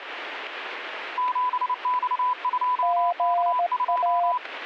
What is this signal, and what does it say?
Morse code, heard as two keyed tones, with radio static. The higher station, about 29 wpm, 1000 Hz: 7X2K2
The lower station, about 17 wpm, 700 Hz: GA